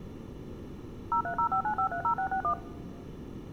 DTMF, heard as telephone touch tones, dialled by machine, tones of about 90 ms. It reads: 03059530661